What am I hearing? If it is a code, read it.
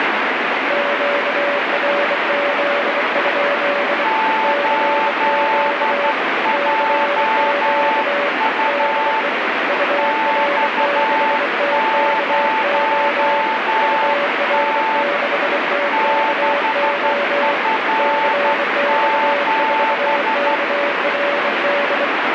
Morse code, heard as two keyed tones, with heavy radio static. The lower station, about 24 wpm, 570 Hz: QRZ? CQ CQ DE UR6TKO UR6TKO CX4KRD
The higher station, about 12 wpm, 880 Hz: 8JU X0T 6F7